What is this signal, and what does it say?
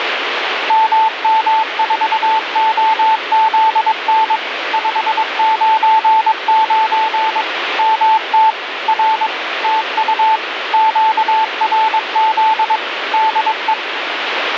Morse code, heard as a keyed tone, machine-sent, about 22 wpm, 880 Hz, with radio static. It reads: MM4OZN 599 MT R TU QRZ DE